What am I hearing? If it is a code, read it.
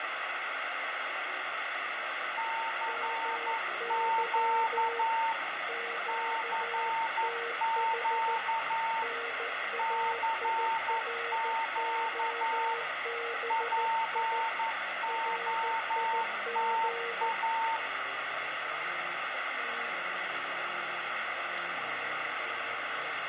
Morse code, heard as two keyed tones, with radio static, fading and room echo. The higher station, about 11 wpm, 900 Hz: CQ CQ CQ POTA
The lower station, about 14 wpm, 470 Hz: MY QTH NAIROBI RIG